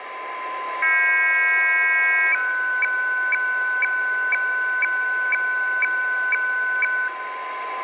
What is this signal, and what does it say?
Weather fax (radiofax), 120 lines a minute, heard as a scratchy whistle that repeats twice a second, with radio static, a steady whistle near 1020 Hz and room echo.